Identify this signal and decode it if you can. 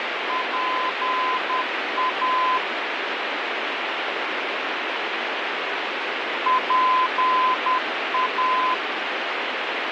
Morse code, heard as a keyed tone, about 10 wpm, 1020 Hz, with heavy radio static and fading. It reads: PA PA